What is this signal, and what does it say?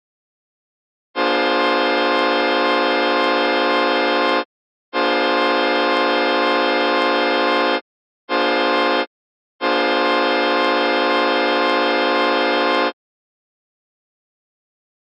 Train horn signal, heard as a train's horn. 2 long, 1 short, 1 long. On North American railways: approaching a public crossing.